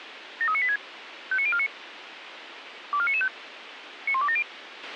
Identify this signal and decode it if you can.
Five-tone selective call (ZVEI), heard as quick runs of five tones, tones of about 70 ms, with radio hiss and a squelch burst at the end. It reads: 73986 59049 24995 91270